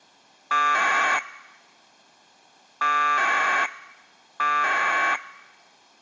Packet radio (AX.25, as in APRS), 1200 baud, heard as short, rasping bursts.